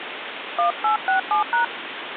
DTMF, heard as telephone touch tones, dialled by hand, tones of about 120 ms, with phone line noise. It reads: 1867#